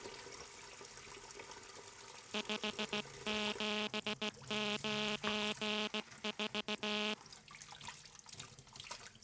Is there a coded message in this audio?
Yes: Morse code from 2.3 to 7.2 s, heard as a buzzer, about 16 wpm, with kitchen noise. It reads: 5794